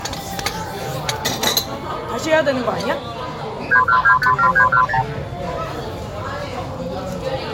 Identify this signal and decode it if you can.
Multi-frequency trunk signalling (R2, with the far end's replies), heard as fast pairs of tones, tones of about 80 ms, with the noise of a restaurant. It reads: 31257310